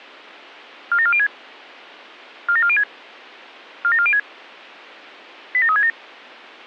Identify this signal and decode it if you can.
Five-tone selective call (ZVEI), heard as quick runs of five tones, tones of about 70 ms. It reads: 47406 47406 47406 87367